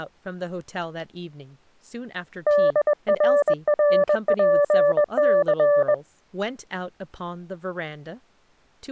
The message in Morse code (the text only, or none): DRRPC